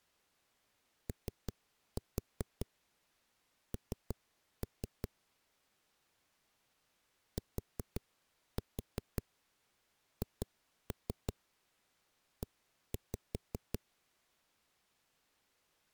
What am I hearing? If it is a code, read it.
Tap code, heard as knocks on a wall, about 5 knocks a second. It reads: ON THE